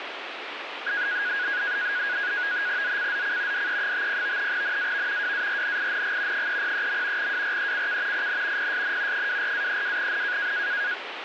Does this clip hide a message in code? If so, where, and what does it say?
Yes: NAVTEX (SITOR-B), 100 baud, 170 Hz shift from 0.9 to 10.9 s, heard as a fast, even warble, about 1550 Hz centre, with radio static. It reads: ZCZC DE50 NAV WARNING 303. WRECK IN PSN 24-32N